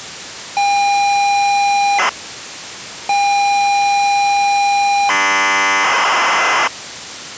ZX Spectrum tape loading, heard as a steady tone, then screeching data.